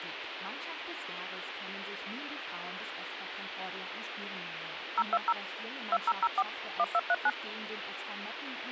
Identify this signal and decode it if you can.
DTMF, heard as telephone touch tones, dialled by machine, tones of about 50 ms, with phone line noise. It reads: 020 2004 1239